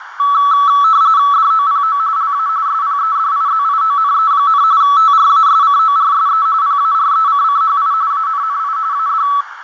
RTTY (45.45 baud, 170 Hz shift), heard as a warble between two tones, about 1220 Hz centre, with radio static, fading and a narrow filter. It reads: DOPO LA SPEDIZIONE, TRASCORSE PARECCHI ANNI AD